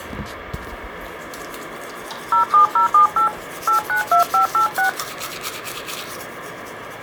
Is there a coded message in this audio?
Yes: DTMF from 2.3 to 4.9 s, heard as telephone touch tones, dialled by hand, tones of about 110 ms, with the noise of a restroom. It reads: 07078 892586